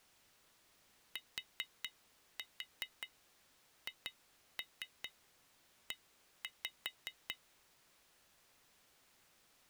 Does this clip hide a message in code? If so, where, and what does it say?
Yes: tap code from 1.2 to 7.4 s, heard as taps on glass, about 5 knocks a second. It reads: THE